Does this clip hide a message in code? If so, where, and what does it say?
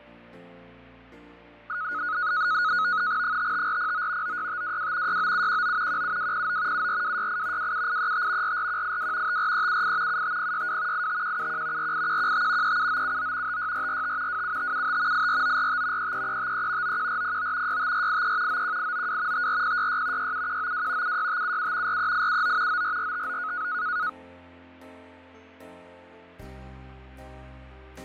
Yes: NAVTEX (SITOR-B), 100 baud, 170 Hz shift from 1.7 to 24.1 s, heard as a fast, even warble, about 1360 Hz centre, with fading. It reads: 55409 96522 69719 17209 74268 27835 44182 54378 75062 85171 48115 37979 56445 27575 84945 33353 91409 65483 91892 54066 67192 76577 43879 94459